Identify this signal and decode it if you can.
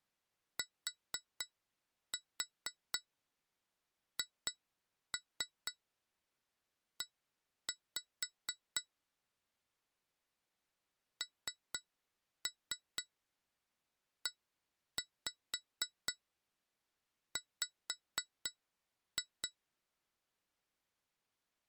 Tap code, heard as taps on glass, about 4 knocks a second. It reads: THE NEW